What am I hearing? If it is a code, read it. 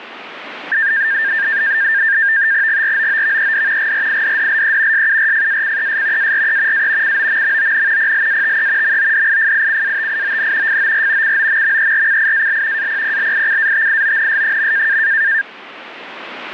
NAVTEX (SITOR-B), 100 baud, 170 Hz shift, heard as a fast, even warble, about 1700 Hz centre, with radio static. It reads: GROOVED GRIDDLE SURFACES ARE A COMMON PLATE MODIFICATION FOR COMMERCIAL APPLICATIONS.